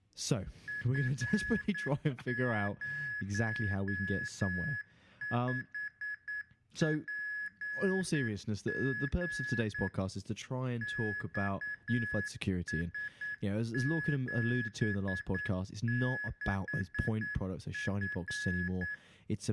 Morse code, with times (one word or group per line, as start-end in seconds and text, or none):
0.7-9.9 F05PG
10.8-18.9 XS76F